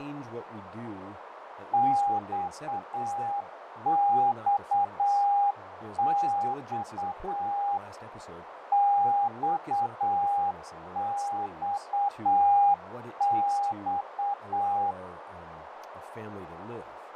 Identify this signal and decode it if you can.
Morse code, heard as a keyed tone, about 8 wpm, 810 Hz, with radio static, fading, a narrow filter and speech in English. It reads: XXX XXX